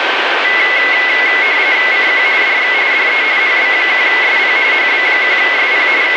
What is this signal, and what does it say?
RTTY (45.45 baud, 170 Hz shift), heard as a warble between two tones, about 2100 Hz centre, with radio static and a steady whistle near 1550 Hz. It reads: CQ DX DE HB1SP HB1SP …